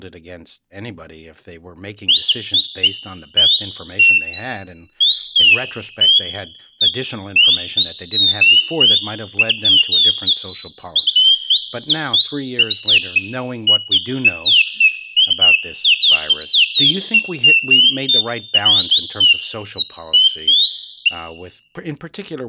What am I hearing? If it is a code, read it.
Bird-like chirps, with room echo and speech in English. There is no code.